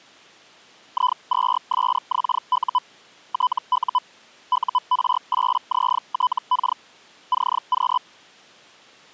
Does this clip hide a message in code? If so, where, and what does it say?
Yes: Hellschreiber (Feld-Hell, 122.5 baud) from 0.9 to 8.0 s, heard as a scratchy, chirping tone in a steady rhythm, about 1000 Hz. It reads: I2SXU TU UR8ZTK CQ